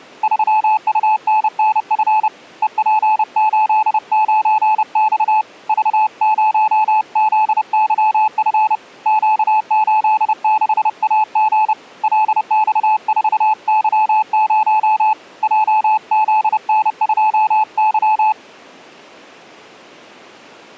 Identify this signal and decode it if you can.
Morse code, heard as a keyed tone, hand-sent with a paddle, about 30 wpm, 860 Hz. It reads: 3UNNF EP89X V0ZYF Q86AG LX4Y0 JZN2Y